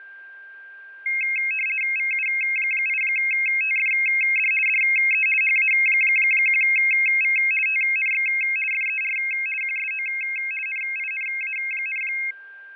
RTTY (50 baud, 450 Hz shift), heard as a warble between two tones, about 2350 Hz centre, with fading and a steady whistle near 1590 Hz. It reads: VU8TFD DE HA1V TNX FER QSO NINA,